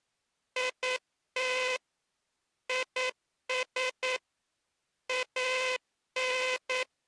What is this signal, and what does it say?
Morse code, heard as a buzzer, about 9 wpm. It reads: IT IS AN